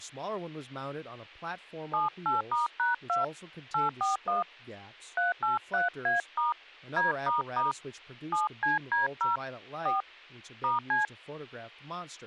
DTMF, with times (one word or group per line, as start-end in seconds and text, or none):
1.9-3.2 78*#2
3.7-4.4 841
5.2-6.5 383A*
7.0-7.7 D**
8.3-9.4 7CD0
9.9-10.0 4
10.6-11.0 *C